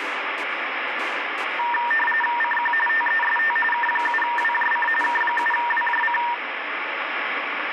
RTTY (45.45 baud, 850 Hz shift), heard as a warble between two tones, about 1380 Hz centre, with radio static. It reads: CQ TEST K7WJC K7WJC